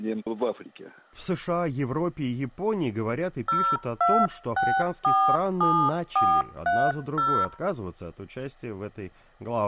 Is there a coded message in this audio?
Yes: DTMF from 3.5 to 7.4 s, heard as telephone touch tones, dialled by hand, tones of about 270 ms. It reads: 02647430